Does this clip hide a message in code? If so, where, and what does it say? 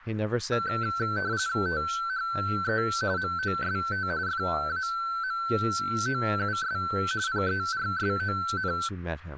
Yes: RTTY (45.45 baud, 170 Hz shift) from 0.5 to 8.9 s, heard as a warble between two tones, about 1440 Hz centre, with speech in English. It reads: THE MOST FAMOUS PERSON